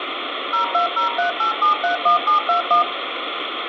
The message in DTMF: 02038731721

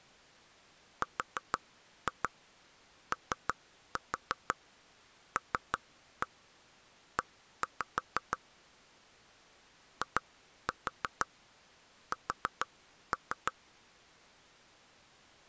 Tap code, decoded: ROLE IS

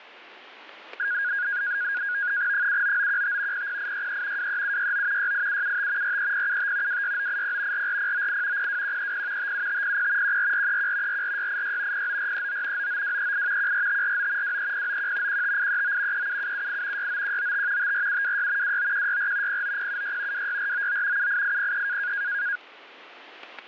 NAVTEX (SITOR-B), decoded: 79915 00863 23769 68775 43075 26980 44098 02130 57500 14431 44686 09439 99238 14549 23091 15839 37778 69195 54726 29164 09076 26499 78803

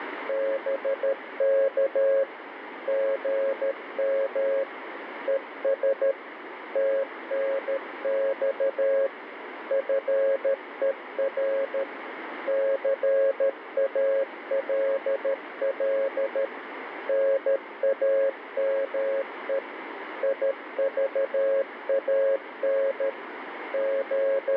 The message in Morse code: BK GM ES TNX FER CALL NAME IVAN …

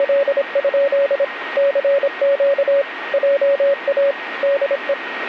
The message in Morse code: … CQ JA DE

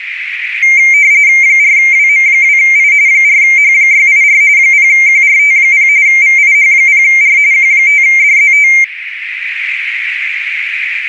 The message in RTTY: 4WM2I 4H684 0QRT0 VIH0R Q5DZT

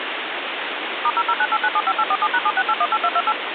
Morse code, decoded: none

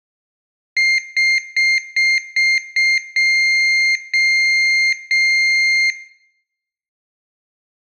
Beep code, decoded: 6 short, 3 long

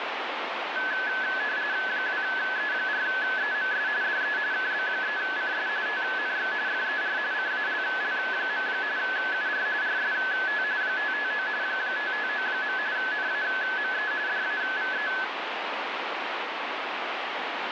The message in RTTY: 2E4EMS DE KB3CS TNX FER CALL. UR RST 559 559. NAME DAVE

